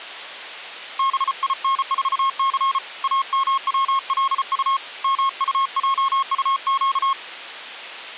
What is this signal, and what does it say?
Morse code, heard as a keyed tone, hand-sent with a paddle, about 34 wpm, 1080 Hz. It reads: BIN4C AMWLU MUJUQ